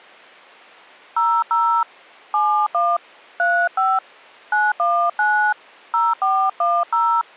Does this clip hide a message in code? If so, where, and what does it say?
Yes: DTMF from 1.2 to 7.2 s, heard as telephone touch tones, dialled by hand, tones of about 270 ms. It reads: 00 71 35 919 0410